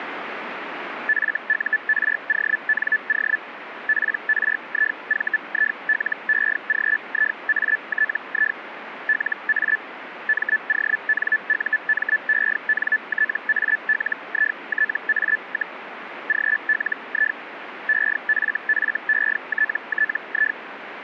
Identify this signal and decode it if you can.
Hellschreiber (Feld-Hell, 122.5 baud), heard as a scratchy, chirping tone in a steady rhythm, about 1750 Hz, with radio static. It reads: FURONO PRIVILEGIATI LA MONUMENTALITA, GLI EFFETTI